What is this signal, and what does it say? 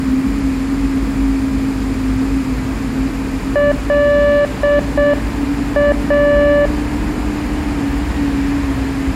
Morse code, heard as a keyed tone, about 7 wpm, 580 Hz, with street noise. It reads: LA